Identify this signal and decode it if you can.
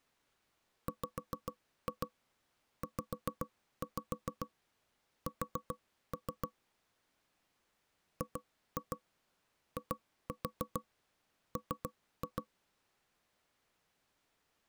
Tap code, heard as knocks on wood, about 7 knocks a second. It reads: WZS GIM